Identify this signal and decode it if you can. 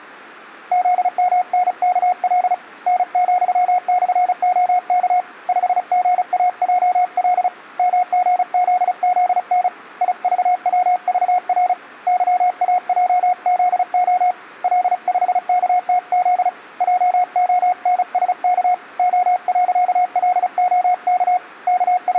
Morse code, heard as a keyed tone, hand-sent with a paddle, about 35 wpm, 720 Hz, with room echo. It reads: ZMNKL N,/OK 5GAJL MGZZN IVWVR YAJZO L5KTZ JONSK O.LOK …